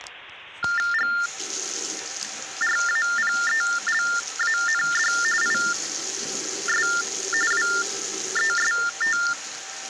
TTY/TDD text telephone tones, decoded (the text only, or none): GRAPELAND IS WEST